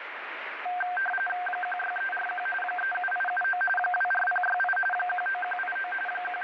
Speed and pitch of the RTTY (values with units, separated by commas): 45.45 baud, 850 Hz shift, 1140 Hz centre